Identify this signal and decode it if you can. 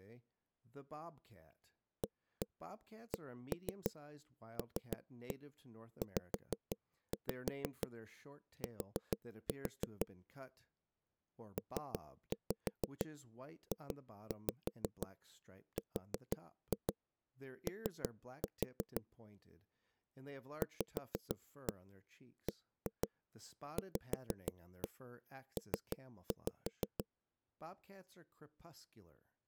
Tap code, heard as knocks on a wall, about 6 knocks a second, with speech in English. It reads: ACLZT PJRO VBVP